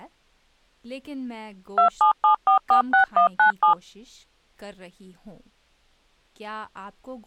DTMF, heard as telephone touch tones, dialled by machine, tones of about 110 ms, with speech in English. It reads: 277446197